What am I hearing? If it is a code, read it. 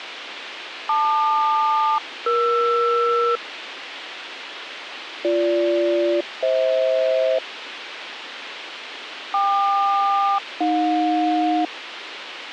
Aircraft SELCAL, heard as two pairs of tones, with radio hiss. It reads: LQ-ER BG-FH KQ-AJ